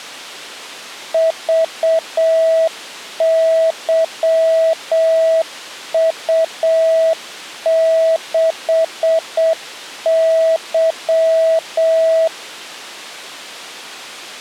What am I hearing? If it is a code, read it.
Morse code, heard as a keyed tone, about 7 wpm, 650 Hz. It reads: VYU6Y